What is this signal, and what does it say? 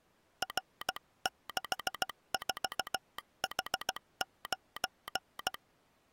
Morse code, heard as a telegraph sounder, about 16 wpm. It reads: R64H9